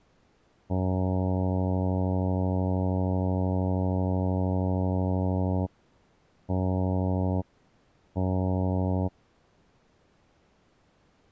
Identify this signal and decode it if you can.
Ship horn signal, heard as a ship's horn, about 90 Hz. 1 long, 2 short. At sea: a vessel in fog that is sailing, fishing, towing or hampered.